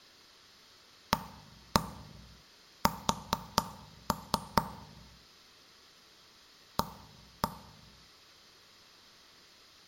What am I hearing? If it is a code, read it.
Tap code, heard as knocks on wood, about 4 knocks a second, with room echo. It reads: AS A